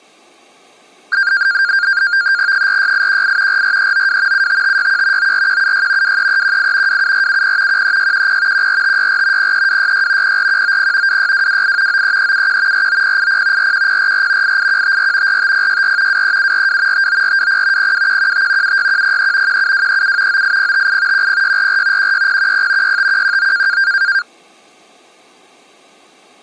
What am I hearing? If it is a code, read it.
NAVTEX (SITOR-B), 100 baud, 170 Hz shift, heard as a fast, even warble, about 1500 Hz centre. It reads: 46818 44392 75561 94176 23318 27470 13610 14564 03266 04190 26228 93371 49080 41044 88154 45064 23742 59420 02115 76103 17237 98058 10644 16010 65119